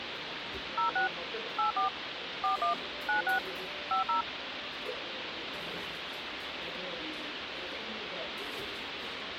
DTMF, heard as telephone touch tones, dialled by machine, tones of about 120 ms, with phone line noise and the noise of a restaurant. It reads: 06 84 41 96 50